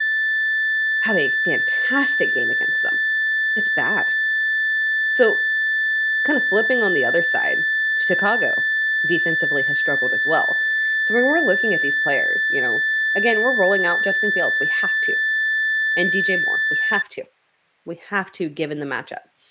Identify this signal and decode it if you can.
A steady tone, with speech in English. There is no code.